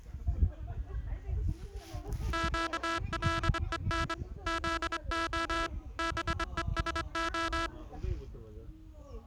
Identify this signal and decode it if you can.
Morse code (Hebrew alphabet), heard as a buzzer, hand-sent with a straight key, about 24 wpm, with the noise of a park. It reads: קלון זה בושה